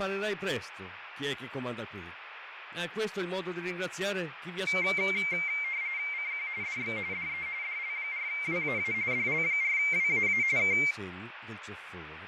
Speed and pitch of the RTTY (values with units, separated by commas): 45.45 baud, 170 Hz shift, 2200 Hz centre